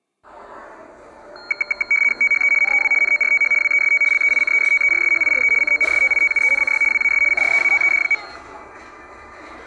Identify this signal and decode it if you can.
RTTY (75 baud, 850 Hz shift), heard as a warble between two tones, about 1850 Hz centre, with the noise of a cafe. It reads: THE NEW NORTH WEST LEICESTERSHIRE CONSTITUENCY WAS CREATED.